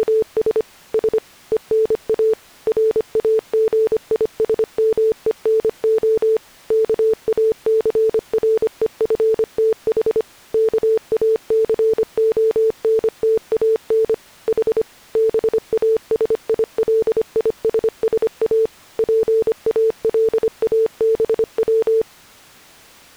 Morse code (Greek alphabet), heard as a keyed tone, machine-sent, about 25 wpm, 440 Hz. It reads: … Σ ΕΝΑ ΡΑΓΙΣΜΕΝΟ ΚΑΘΡΕΦΤΗ ΚΑΘΟΝΤΑΝ Η ΒΑΣΙΛΙΣΣΑ ΠΑΛΑΒΩ